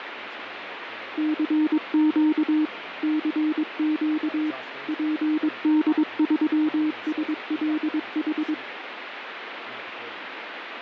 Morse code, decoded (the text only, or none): CQ CQ PD3SLH